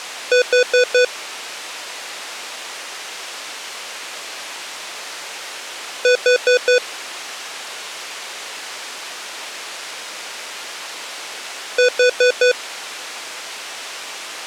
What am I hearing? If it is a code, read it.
Alarm pattern, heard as an alarm's beeps, played three times, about 500 Hz. Temporal four. Carbon monoxide.